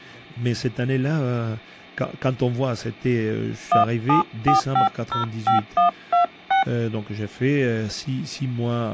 DTMF, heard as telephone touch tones, dialled by hand, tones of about 120 ms, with speech in French. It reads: 174505126